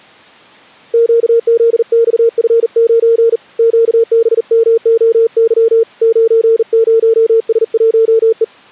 Morse code, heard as a keyed tone, hand-sent with a bug key, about 40 wpm, 460 Hz. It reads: QZXF9 QBMOY 90S1E